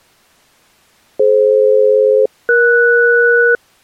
Aircraft SELCAL, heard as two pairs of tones. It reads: DF-ES